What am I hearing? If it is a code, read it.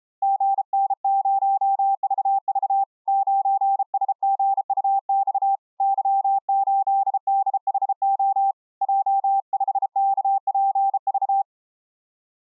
Morse code, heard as a keyed tone, hand-sent with a bug key, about 33 wpm, 790 Hz. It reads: GN0VV 9SGUX Y8DHO J5KPV